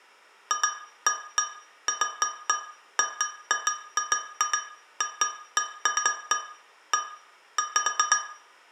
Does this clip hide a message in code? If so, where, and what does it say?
No, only irregular taps on glass, with room echo.